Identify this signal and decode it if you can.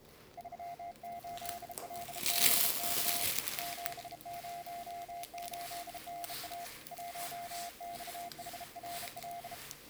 Morse code, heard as a keyed tone, hand-sent with a bug key, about 33 wpm, 700 Hz, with the noise inside a lift. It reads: 38LBK 708NA 1XHRL